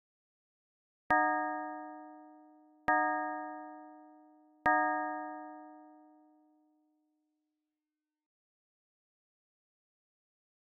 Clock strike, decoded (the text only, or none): 3